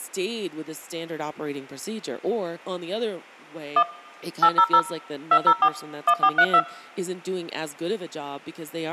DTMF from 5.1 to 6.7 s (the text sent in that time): 204 1432